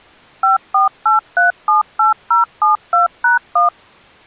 DTMF, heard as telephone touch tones, dialled by machine, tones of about 140 ms. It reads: 548378072#1